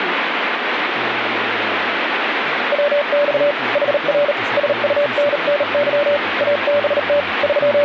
Morse code, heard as a keyed tone, hand-sent with a bug key, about 38 wpm, 580 Hz, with radio static. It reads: WX HR SUNNY ABT …